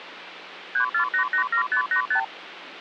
Multi-frequency trunk signalling (R2, with the far end's replies), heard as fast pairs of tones, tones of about 100 ms, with phone line noise. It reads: 34887585